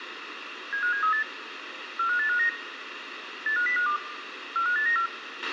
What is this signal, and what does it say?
Five-tone selective call (CCIR), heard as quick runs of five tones, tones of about 100 ms, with radio hiss, a squelch burst at the end and room echo. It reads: 75738 45859 85052 45894